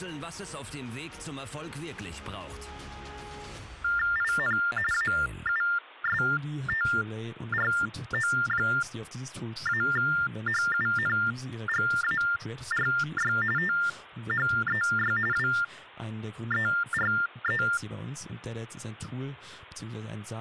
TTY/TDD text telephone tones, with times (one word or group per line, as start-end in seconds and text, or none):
4.2-4.6 IN
4.9-13.3 AUSTRO-HUNGARY
13.6-15.2 THEY
15.3-17.6 WERE